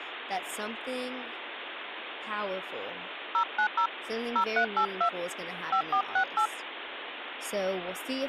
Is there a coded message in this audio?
Yes: DTMF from 3.3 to 6.5 s, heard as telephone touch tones, dialled by hand, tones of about 90 ms, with phone line noise and speech in English. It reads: 090 0382 5468